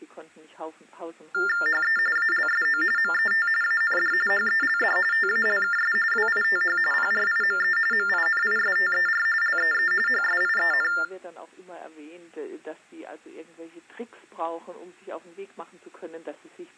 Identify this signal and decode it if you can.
TTY/TDD text telephone tones (45.45 baud Baudot), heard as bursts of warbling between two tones, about 400 Hz shift, 1600 Hz centre. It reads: HE ALSO MET AND HELD TALKS WITH PRIME MINISTER LEE HSIEN